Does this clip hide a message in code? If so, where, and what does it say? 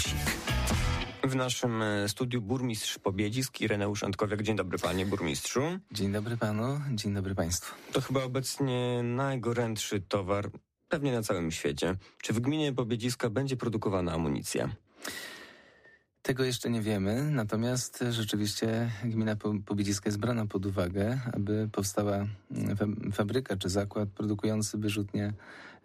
No.